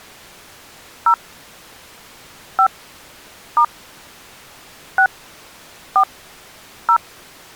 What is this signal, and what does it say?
DTMF, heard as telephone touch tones, dialled by hand, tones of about 80 ms. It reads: 0 5 * 6 4 0